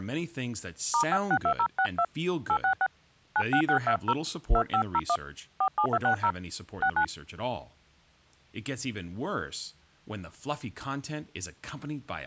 DTMF, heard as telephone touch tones, dialled by hand, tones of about 70 ms, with speech in English. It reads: *562062 866 96620 2501 47260 69